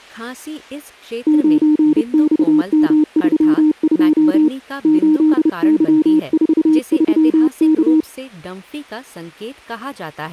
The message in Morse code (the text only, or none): 9XM32 8Y43K